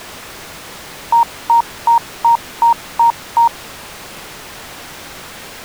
Beep code, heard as beeps, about 930 Hz. 7 short. In AMI BIOS tables: virtual mode exception error; in Dell tables: processor failure.